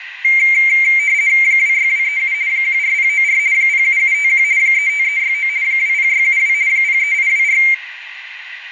RTTY (50 baud, 170 Hz shift), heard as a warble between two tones, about 2200 Hz centre, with radio static. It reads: 26237 14094 07751 35369 20672 03824